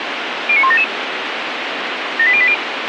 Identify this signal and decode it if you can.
Five-tone selective call (ZVEI), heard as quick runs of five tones, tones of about 70 ms, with radio hiss and a squelch burst at the end. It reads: 09177 78080